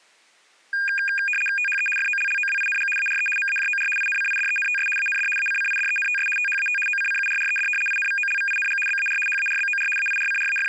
RTTY (75 baud, 850 Hz shift), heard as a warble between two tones, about 2050 Hz centre. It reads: THE FOLLOWING ARE MAJOR INCIDENTS AND ACCIDENTS THAT OCCURRED INVOLVING BAR HARBOR …